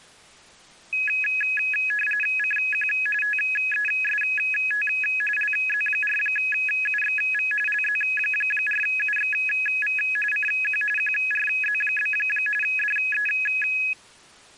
RTTY (45.45 baud, 850 Hz shift), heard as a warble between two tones, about 2100 Hz centre. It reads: CQ TEST LZ4UXV LZ4UXV CQ QRZ? DE